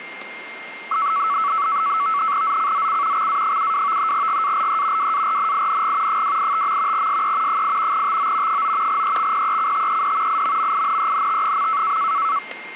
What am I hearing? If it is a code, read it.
NAVTEX (SITOR-B), 100 baud, 170 Hz shift, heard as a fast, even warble, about 1220 Hz centre, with a steady whistle near 2110 Hz. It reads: ZCZC XA72 GALE WARNING 285. SE 8 TO 9 EXPECTED IMMINENT.